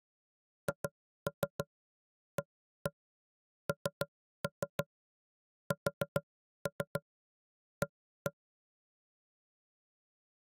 Tap code, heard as knocks on wood, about 6 knocks a second. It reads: HANSA